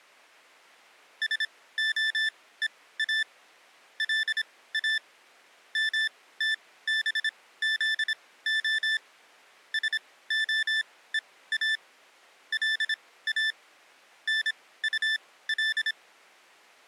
Morse code (Hebrew alphabet), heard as electronic beeps, machine-sent, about 26 wpm, spaced as for 17 wpm, 1750 Hz. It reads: שהוא לא מתבזה שהוא לא נטל